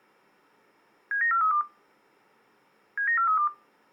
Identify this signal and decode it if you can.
Five-tone selective call (CCIR), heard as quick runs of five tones, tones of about 100 ms. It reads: 79432 79432